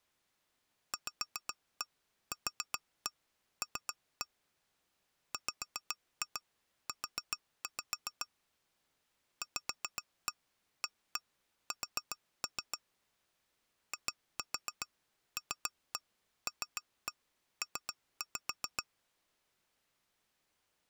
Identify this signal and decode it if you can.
Tap code, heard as taps on glass, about 7 knocks a second. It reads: VQL WU VAS ILLP